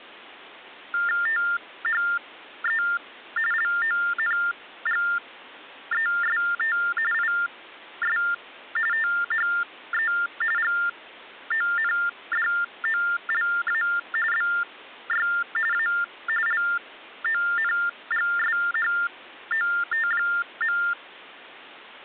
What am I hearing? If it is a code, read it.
TTY/TDD text telephone tones (45.45 baud Baudot), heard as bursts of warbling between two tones, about 400 Hz shift, 1600 Hz centre. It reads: THE LONGEST IS THE GONDOLA BY A LONGSHOT.